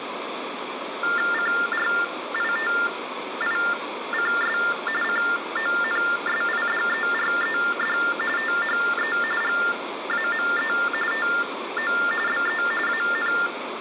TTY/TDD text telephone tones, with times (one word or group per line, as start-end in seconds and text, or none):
1.3-4.6 CRITICS
5.0-8.0 CONSIDERED
8.4-9.2 THE
9.4-10.7 GAME
11.1-11.9 TO
12.3-12.6 BE
12.9-13.3 AN